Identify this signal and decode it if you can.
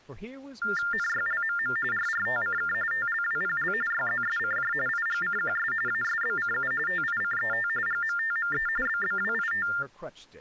TTY/TDD text telephone tones (45.45 baud Baudot), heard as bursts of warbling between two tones, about 400 Hz shift, 1600 Hz centre, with speech in English. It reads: NYLMM RRTCK TLWPL YZSCJ IGCQS ASBCU TICET GMTME BBWIT